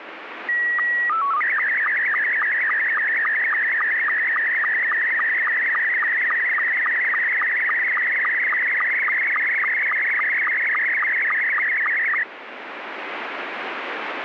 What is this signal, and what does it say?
SSTV (slow-scan television), Scottie S2, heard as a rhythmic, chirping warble, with radio static.